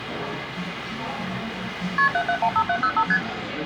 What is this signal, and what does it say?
Multi-frequency trunk signalling (R1, as on North American trunks), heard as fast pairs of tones, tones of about 70 ms, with phone line noise and the noise of a cafe. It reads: KP 7715705 ST